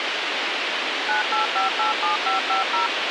DTMF, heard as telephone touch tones, dialled by machine, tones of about 130 ms, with radio hiss and a squelch burst at the end. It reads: 98587550